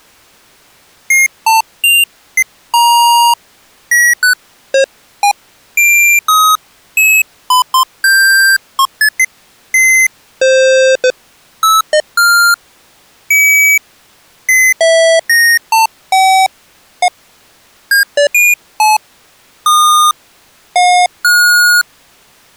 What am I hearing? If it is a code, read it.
Electronic bleeps of random pitch and length. There is no code.